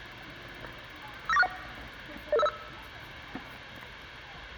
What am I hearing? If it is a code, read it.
Five-tone selective call (EIA), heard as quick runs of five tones, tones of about 30 ms, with the noise of a park. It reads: 59461 00505